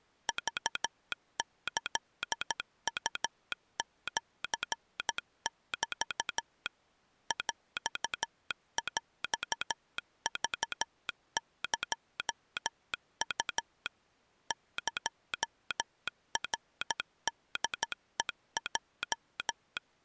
Morse code (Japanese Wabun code), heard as a telegraph sounder, machine-sent, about 13 wpm. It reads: クキウシメ ヰヰクエウ エナホヘヲ